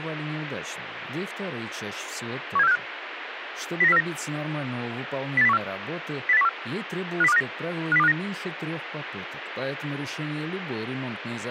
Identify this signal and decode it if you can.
Five-tone selective call (EEA), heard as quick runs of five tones, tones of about 40 ms, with radio hiss. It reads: 17465 09049 08014 08014 50259 50259